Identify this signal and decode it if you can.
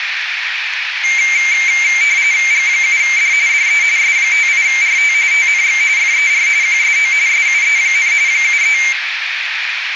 RTTY (45.45 baud, 170 Hz shift), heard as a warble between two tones, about 2200 Hz centre, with radio static and a narrow filter. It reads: G7D DE S58RT TNX FER QSO SUE, 73